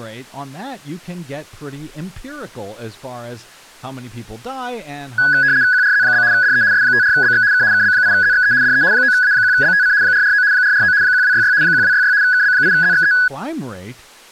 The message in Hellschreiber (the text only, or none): none